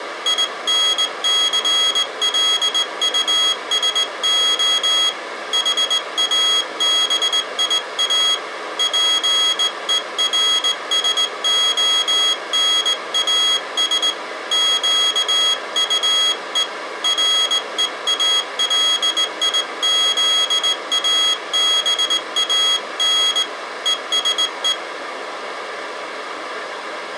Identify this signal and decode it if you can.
Morse code, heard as a high beeper, hand-sent with a straight key, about 19 wpm, 3300 Hz. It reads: INCLUSO HABIA PERSONAS QUE REALIZABAN ESE